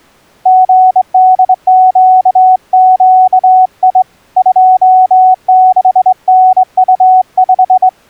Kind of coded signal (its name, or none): Morse code